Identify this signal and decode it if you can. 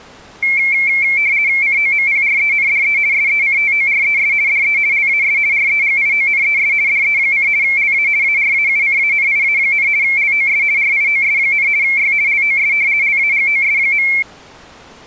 RTTY (50 baud, 170 Hz shift), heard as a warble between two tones, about 2250 Hz centre. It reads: COMPRENDE SECTORES DE LAS REGIONES DE: LA ARAUCANIA, LOS RIOS, Y LOS LAGOS.